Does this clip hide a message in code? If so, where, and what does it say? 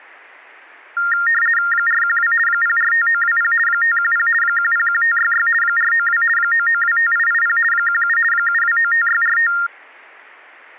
Yes: RTTY (50 baud, 450 Hz shift) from 1.0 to 9.7 s, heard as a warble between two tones, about 1600 Hz centre. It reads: 412 045920 510 101566 492 9925880 17 7295645